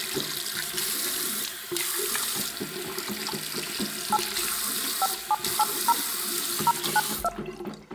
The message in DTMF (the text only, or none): 8 5780 092